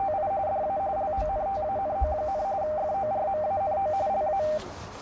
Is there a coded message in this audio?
Yes: RTTY (45.45 baud, 170 Hz shift) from 0.0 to 4.6 s, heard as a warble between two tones, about 700 Hz centre, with radio static, a narrow filter and the noise inside a subway train. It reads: … DA LONTANO, FORMANO LA